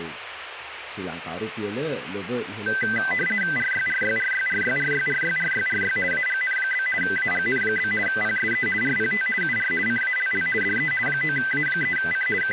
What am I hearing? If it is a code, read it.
RTTY (50 baud, 450 Hz shift), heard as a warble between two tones, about 1800 Hz centre, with radio static. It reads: RYRYRYRYRYRYRYRY AGN? AGN? PSE RPT UR CALL DE 9A3C …